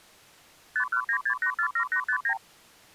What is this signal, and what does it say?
Multi-frequency trunk signalling (R2, with the far end's replies), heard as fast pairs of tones, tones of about 80 ms. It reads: 5196847859